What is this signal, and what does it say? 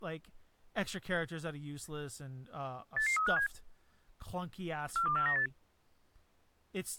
Five-tone selective call (CCIR), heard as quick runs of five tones, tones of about 100 ms, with speech in English. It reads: 88357 42498